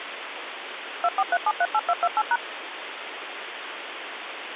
DTMF, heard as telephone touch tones, dialled by machine, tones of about 50 ms, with phone line noise. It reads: 243738228#